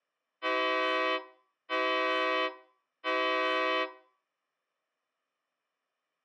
Train horn signal, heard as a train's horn, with room echo. 3 short. On North American railways: when stopped, the train will back up.